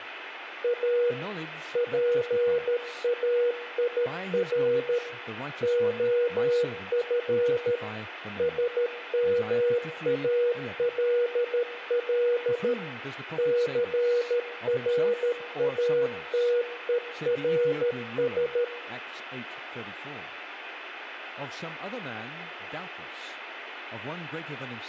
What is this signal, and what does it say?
Morse code, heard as a keyed tone, machine-sent, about 13 wpm, 480 Hz, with room echo and speech in English. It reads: A PAIR OF SMALL CRATERS